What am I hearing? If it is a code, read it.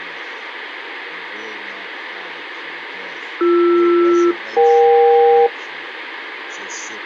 Aircraft SELCAL, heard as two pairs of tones, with radio hiss. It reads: BR-EK